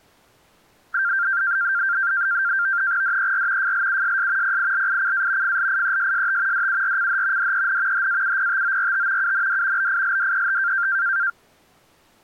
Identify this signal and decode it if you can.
NAVTEX (SITOR-B), 100 baud, 170 Hz shift, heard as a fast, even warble, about 1480 Hz centre. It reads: DER FLUSS PILICA FLIESST DURCH DEN HAUPTORT UND BILDET